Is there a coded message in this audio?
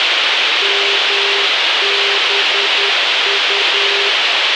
Yes: Morse code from 0.6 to 4.2 s, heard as a keyed tone, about 10 wpm, 400 Hz, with radio hiss. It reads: MBU